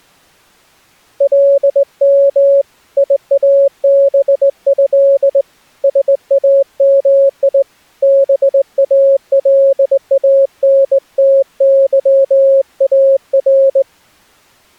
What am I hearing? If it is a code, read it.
Morse code (Arabic alphabet), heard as a keyed tone, hand-sent with a straight key, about 19 wpm, 550 Hz. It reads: لم يابه سامي بالانتظار